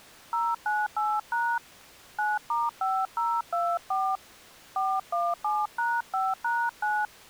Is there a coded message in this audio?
Yes: DTMF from 0.3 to 7.1 s, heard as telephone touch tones, dialled by hand, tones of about 230 ms. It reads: 098# 9*5024 417#5#9